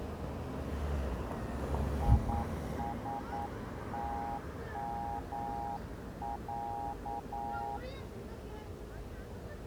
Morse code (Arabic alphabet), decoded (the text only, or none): يستمع